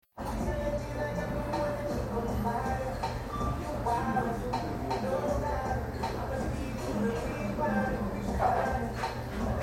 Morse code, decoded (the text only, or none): none